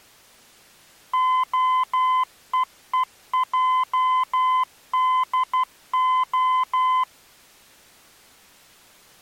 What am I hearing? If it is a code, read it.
Morse code (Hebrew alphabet), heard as a keyed tone, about 12 wpm, 1020 Hz. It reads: הוועדה